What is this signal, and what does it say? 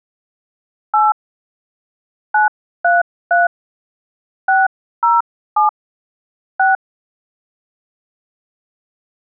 DTMF, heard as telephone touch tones, dialled by hand, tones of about 160 ms. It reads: 8 933 607 6